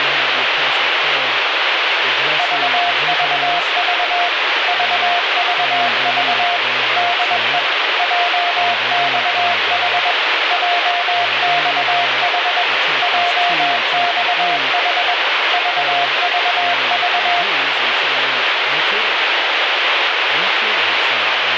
Morse code, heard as a keyed tone, machine-sent, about 21 wpm, 700 Hz, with heavy radio static. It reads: VVV VVV DE JXH JXH JXH VVV